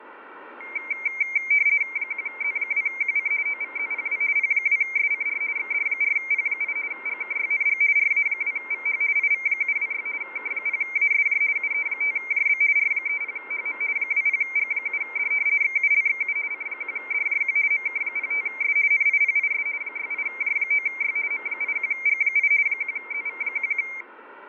RTTY (50 baud, 170 Hz shift), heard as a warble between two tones, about 2200 Hz centre. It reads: 1Z2QC OVZPW P2SCR XD4P8 GKYNG RA2VH IV726 K0ASJ UE5JB R30HM 20G7D XULXU C1DJQ MK05S NIPIS 68J9Y M81G8 1ZV11